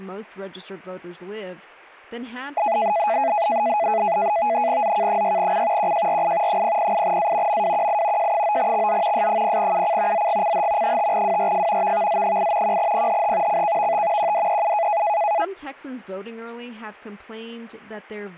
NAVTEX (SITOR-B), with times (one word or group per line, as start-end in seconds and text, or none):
4.8-5.9 ZK6C
5.8-6.6 QJRI
6.5-7.6 008A
7.5-8.3 MWQI
8.2-9.3 J9XZ
9.1-10.3 S0UC
10.1-11.0 ZGCH
10.8-11.9 5WRF
11.8-12.8 VVZ8
12.6-13.6 1PHH
13.5-14.3 CKVT
14.2-15.0 QDEU